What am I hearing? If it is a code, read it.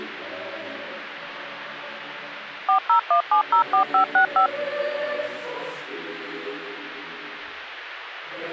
DTMF, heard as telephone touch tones, dialled by machine, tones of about 100 ms. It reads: 401704565